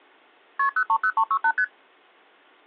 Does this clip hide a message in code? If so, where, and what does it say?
Yes: multi-frequency trunk signalling (R1, as on North American trunks) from 0.6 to 1.6 s, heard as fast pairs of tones, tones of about 70 ms. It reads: KP 030368 ST